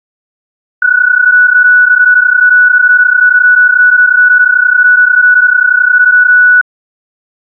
PSK31 (31.25 baud), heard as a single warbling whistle, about 1480 Hz.